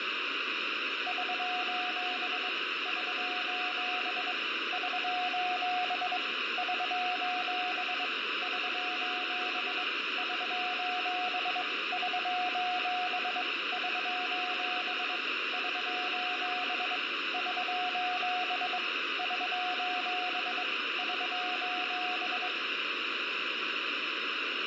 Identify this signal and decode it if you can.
Morse code, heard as a keyed tone, hand-sent with a straight key, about 22 wpm, 730 Hz, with radio static and fading. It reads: <SOS> <SOS> <SOS> <SOS> <SOS> <SOS> <SOS> <SOS> <SOS> <SOS> <SOS> <SOS>